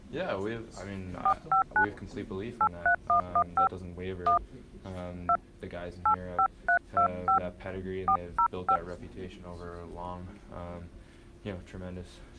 DTMF, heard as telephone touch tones, dialled by hand, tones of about 90 ms. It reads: 459 83115 1 2 85325 405